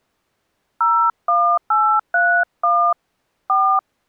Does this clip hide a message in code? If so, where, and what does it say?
Yes: DTMF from 0.8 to 3.8 s, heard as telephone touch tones, dialled by hand, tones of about 300 ms. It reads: 01831 4